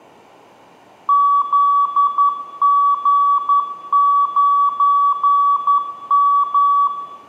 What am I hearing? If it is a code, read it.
Morse code, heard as a keyed tone, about 11 wpm, 1140 Hz, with room echo. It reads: ZG9M